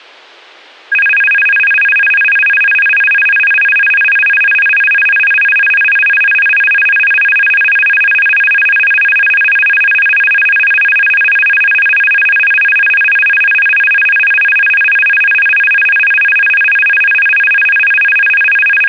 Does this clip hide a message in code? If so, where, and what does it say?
No, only a tone that alternates evenly between two pitches.